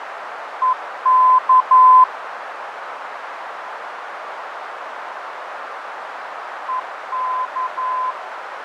Morse code, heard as a keyed tone, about 11 wpm, 1020 Hz, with radio static, fading and a narrow filter. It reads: EK EK